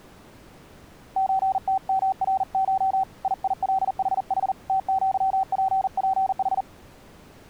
Morse code (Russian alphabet), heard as a keyed tone, hand-sent with a paddle, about 40 wpm, 770 Hz. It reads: ЧТМРШ ИИЛХХ ТЪППХ